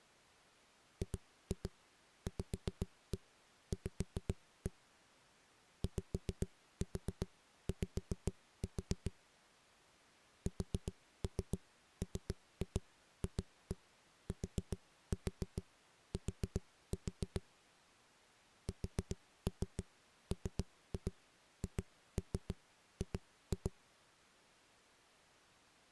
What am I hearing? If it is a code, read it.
Tap code, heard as knocks on a wall, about 7 knocks a second. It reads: GVV YY SMFTT SMHG